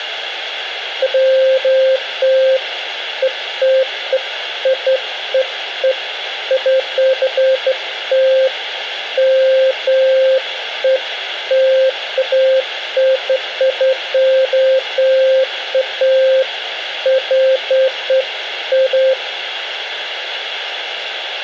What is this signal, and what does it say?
Beeps of irregular length, with radio hiss. There is no code.